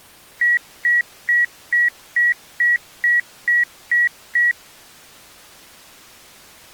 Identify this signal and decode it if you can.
Beep code, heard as beeps, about 1900 Hz. 10 short. In AMI BIOS tables: CMOS shutdown register error.